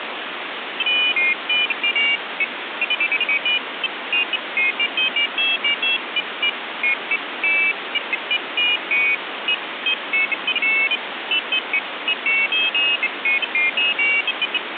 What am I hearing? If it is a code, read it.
Pairs of high tones at irregular times, with phone line noise. There is no code.